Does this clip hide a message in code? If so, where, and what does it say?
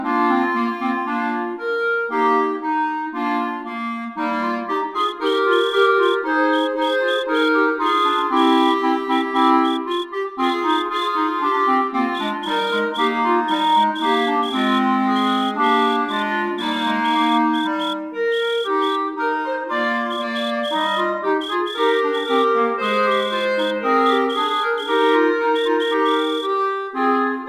Yes: Morse code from 4.9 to 26.5 s, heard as a whistle, hand-sent with a straight key, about 9 wpm. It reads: FHMHS ROGZN UWRWU